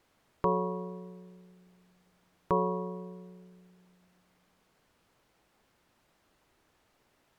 Clock strike, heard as a bell. 2. Two o'clock.